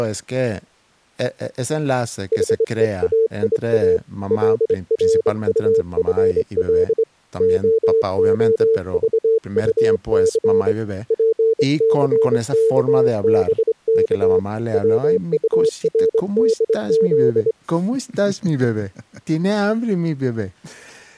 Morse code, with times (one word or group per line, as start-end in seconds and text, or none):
2.3-4.0 HEAIA
4.3-7.0 LRUFL
7.4-10.7 OOVUC
11.1-14.4 PCKBK
14.7-17.5 WURDZ